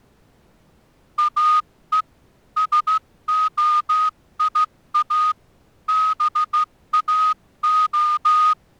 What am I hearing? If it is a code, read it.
Morse code (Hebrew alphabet), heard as a whistle, hand-sent with a straight key, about 14 wpm. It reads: או שהיא באה